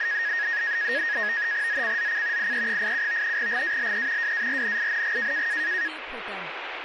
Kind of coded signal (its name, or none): NAVTEX (SITOR-B)